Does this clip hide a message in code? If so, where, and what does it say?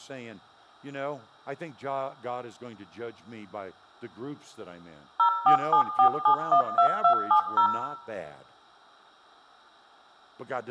Yes: DTMF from 5.2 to 7.7 s, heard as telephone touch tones, dialled by machine, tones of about 90 ms, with room echo and speech in English. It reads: 0474712270